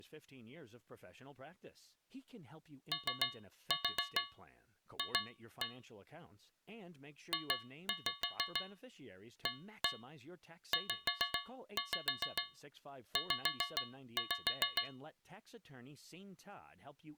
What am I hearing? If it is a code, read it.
Tap code, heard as taps on a metal pipe, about 6 knocks a second, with speech in English. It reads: OF JAZZ